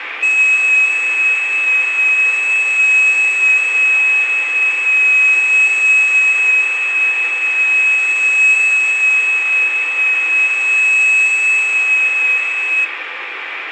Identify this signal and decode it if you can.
FT8 (one signal), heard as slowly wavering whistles, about 6.25 baud, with radio static and room echo.